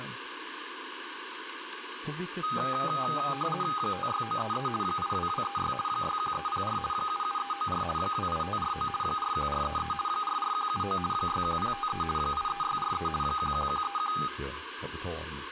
RTTY (50 baud, 450 Hz shift), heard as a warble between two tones, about 1030 Hz centre, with radio static and speech in Swedish. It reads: 56933 82236 61304 77394 28549 41433 44179 61053 83643 11131